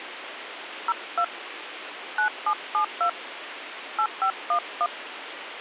DTMF, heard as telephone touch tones, dialled by hand, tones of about 70 ms, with phone line noise. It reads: 02 9772 8511